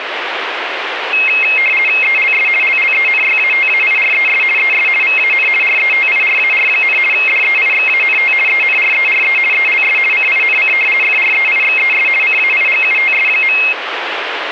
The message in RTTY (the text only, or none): ELS LLENYATAIRES ES VAN RETIRAR, DEIXANT ENRERE ELS CINC FREIXES CAIGUTS.